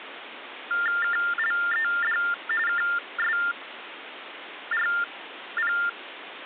TTY/TDD text telephone tones (45.45 baud Baudot), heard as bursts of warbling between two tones, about 400 Hz shift, 1600 Hz centre, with phone line noise. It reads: KLED KSRP